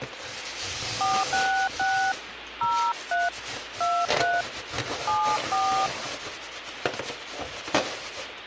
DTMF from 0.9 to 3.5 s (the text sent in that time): 466 03